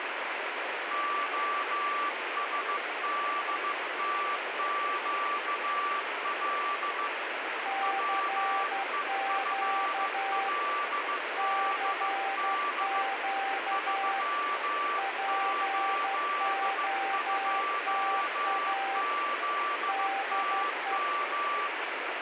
Morse code, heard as two keyed tones, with heavy radio static. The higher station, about 15 wpm, 1160 Hz: OSDTQL WEFLDD 382ZTM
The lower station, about 12 wpm, 780 Hz: CQ CQ POTA DE